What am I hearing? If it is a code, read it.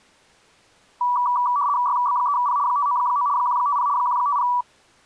RTTY (75 baud, 170 Hz shift), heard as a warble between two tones, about 1060 Hz centre. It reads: YB3P 599 150 150